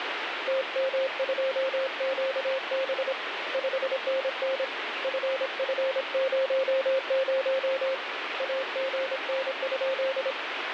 Morse code, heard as a keyed tone, hand-sent with a paddle, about 26 wpm, 530 Hz, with radio static. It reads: TM2QB 5NN FF00 AGN?